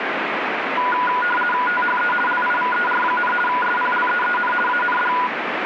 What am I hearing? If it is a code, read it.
RTTY (50 baud, 450 Hz shift), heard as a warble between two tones, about 1220 Hz centre, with radio static. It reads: THE LIVER, SPLEEN AND